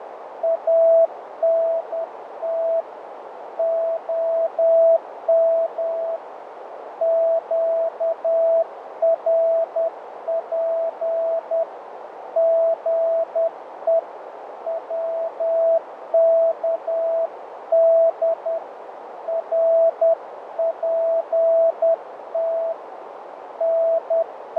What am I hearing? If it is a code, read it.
Morse code, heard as a keyed tone, hand-sent with a paddle, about 10 wpm, 660 Hz, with radio static, fading and a narrow filter. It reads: ANT OM QRP GE WKD RPT …